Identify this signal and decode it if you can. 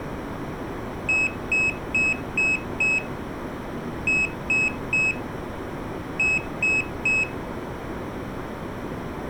Beep code, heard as a piezo beeper, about 2550 Hz, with room echo. 5-3-3.